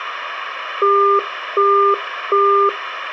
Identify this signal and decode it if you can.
Telephone call progress tone (as in the UK, Australia and similar networks), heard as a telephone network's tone, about 400 Hz, 0.375 s on and 0.375 s off. Busy tone.